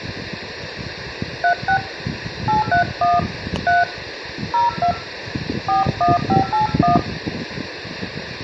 DTMF, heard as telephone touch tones, dialled by hand, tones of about 130 ms, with room echo and the noise of a park. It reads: 36 831 3 02 41581